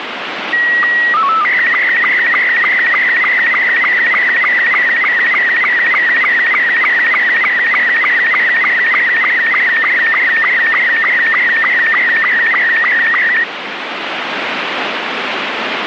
SSTV (slow-scan television), Robot 72, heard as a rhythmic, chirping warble, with radio static.